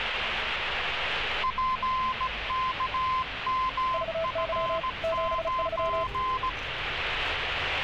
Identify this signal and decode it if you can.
Morse code, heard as two keyed tones, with radio static and street noise. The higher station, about 17 wpm, 1030 Hz: PKMF9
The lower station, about 35 wpm, 660 Hz: VY 73